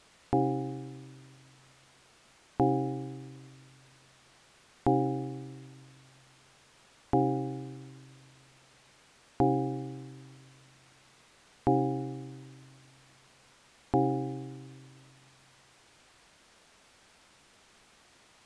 Clock strike, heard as a bell. 7. Seven o'clock.